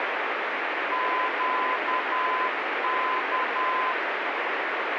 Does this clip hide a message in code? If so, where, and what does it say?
Yes: Morse code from 0.9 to 4.0 s, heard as a keyed tone, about 10 wpm, 1020 Hz, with heavy radio static. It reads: QK